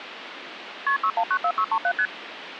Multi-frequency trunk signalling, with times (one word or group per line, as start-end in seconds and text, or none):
0.9-1.0 KP
1.0-1.9 6194637
2.0-2.1 ST